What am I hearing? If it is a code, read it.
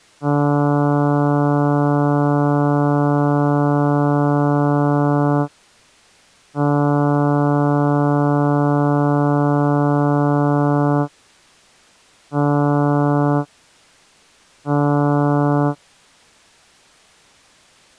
Ship horn signal, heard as a ship's horn, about 140 Hz. 2 long, 2 short. At sea: I intend to overtake on your port side.